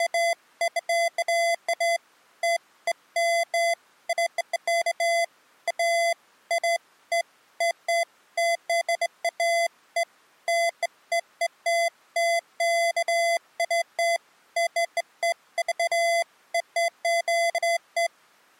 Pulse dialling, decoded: none

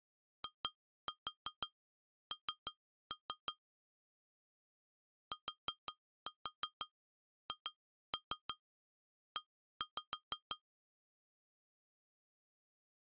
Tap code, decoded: IN THE

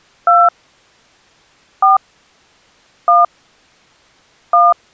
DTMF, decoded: 2 4 1 1

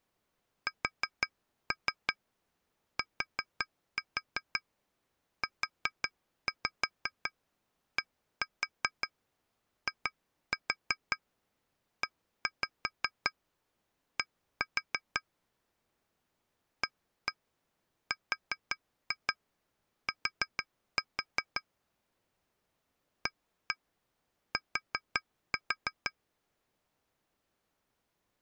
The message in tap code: STUDIED ART AT

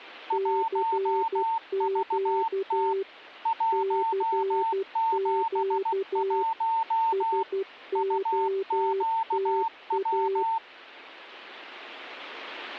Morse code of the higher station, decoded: 1VT 171 UQW

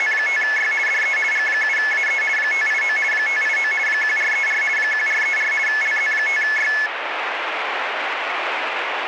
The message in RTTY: … DE G7AE 589 589 1434 1434 LZ5Y

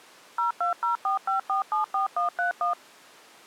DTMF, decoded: 02045474131

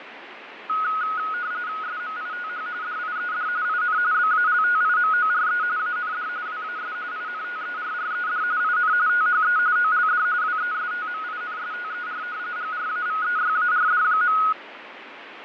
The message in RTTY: SMITH DIED IN BALTIMORE AND WAS INTERRED IN THE OLD WESTMINSTER GRAVEYARD.

